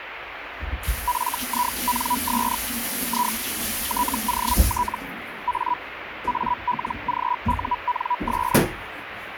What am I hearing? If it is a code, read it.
Hellschreiber (Feld-Hell, 122.5 baud), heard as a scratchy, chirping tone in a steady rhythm, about 980 Hz, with radio static and kitchen noise. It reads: FINS I TOT A ALGUNS